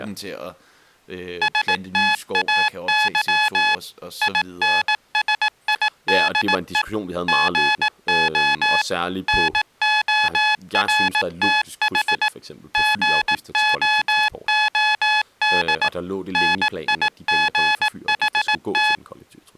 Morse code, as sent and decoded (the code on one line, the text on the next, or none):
... - .- -.-- / .. -. ... .. -.. . / --. --- / -. --- .-. - .... / --. --- --- -.. / -. .. --. .... -
STAY INSIDE GO NORTH GOOD NIGHT